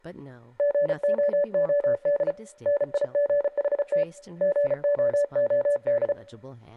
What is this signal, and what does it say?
Morse code, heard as a keyed tone, hand-sent with a paddle, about 34 wpm, 580 Hz, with room echo and speech in English. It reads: GOOD NIGHT GOOD